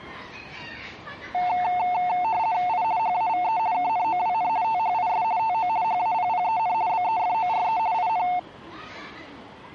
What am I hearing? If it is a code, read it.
RTTY (50 baud, 170 Hz shift), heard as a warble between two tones, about 810 Hz centre, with the noise of a residential street. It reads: I HAVE KNOWN THIS TO HAPPEN BEFORE IN